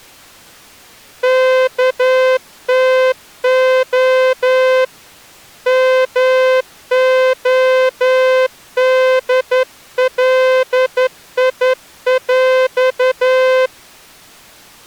Morse code (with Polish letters), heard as a horn, hand-sent with a straight key, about 11 wpm. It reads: KTO MODLIŁ